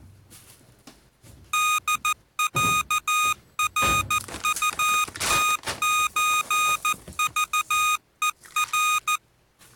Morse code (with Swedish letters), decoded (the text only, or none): DÄRUTÖVER